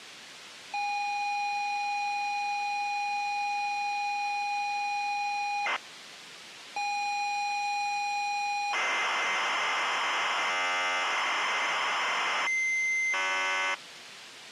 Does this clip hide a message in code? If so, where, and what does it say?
Yes: ZX Spectrum tape loading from 0.7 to 13.7 s, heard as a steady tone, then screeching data.